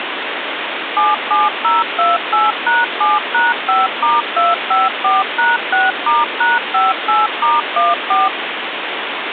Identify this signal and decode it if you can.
DTMF, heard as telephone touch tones, dialled by machine, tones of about 180 ms, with phone line noise. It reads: 77028#7#5*254#6*#58*14